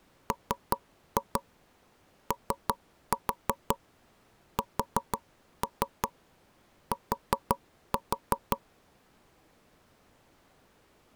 Tap code, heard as knocks on wood, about 5 knocks a second. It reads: MOST